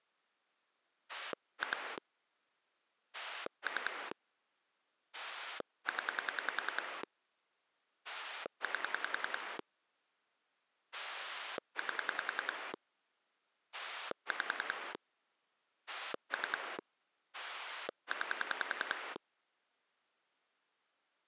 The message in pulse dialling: 2 3 0 8 8 5 3 9

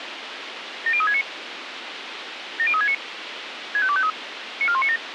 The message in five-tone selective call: 70369 70369 65253 94197

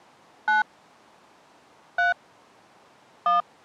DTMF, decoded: 9 3 1

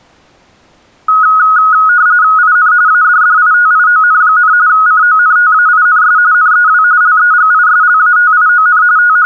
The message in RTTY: IN ADDITION, CONTAINS NEW LEGISLATION …

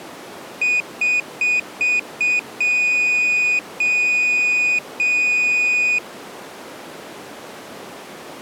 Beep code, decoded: 5 short, 3 long

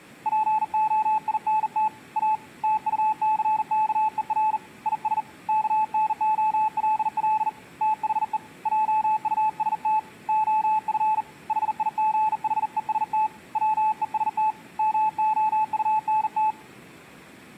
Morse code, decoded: POINT A TUCKER IS KNOLL THE JUST OF HIGHEST WEST MOUNT

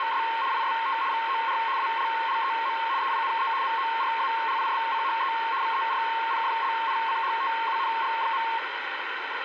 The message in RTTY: … IST VOR ALLEM EINE MORALISCHE VERPFLICHTUNG.

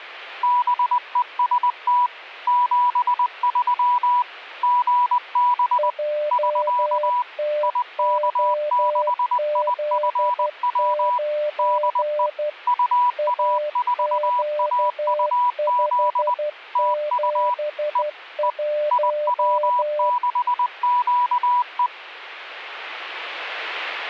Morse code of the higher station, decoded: BEST 73 GB <SK> IK6IFW DE UA4AUZ TU E E IW6QE

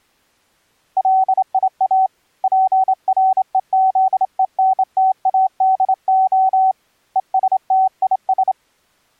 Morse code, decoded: LIA PREZENTADO ESTIS

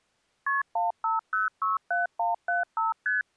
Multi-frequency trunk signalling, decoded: KP 15067175 ST

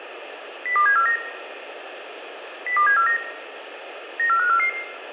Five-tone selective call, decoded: 02749 02749 94544

